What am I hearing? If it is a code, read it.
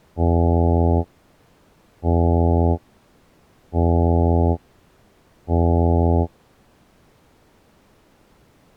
Ship horn signal, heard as a ship's horn, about 80 Hz. 4 short. At sea: a pilot vessel's identity signal in fog.